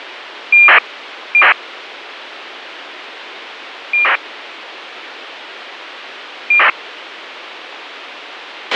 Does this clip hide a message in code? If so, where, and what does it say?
Yes: ACARS aircraft data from 0.5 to 6.7 s, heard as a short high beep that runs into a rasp, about 2400 baud, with radio hiss and a squelch burst at the end.